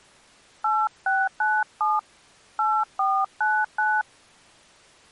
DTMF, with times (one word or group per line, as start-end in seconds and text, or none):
0.6-2.0 8697
2.6-4.0 8499